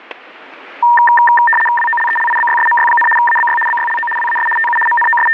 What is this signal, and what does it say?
RTTY (75 baud, 850 Hz shift), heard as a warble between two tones, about 1380 Hz centre, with static crashes. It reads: WOLELIBYSMY, ABY BYLO WAS TU …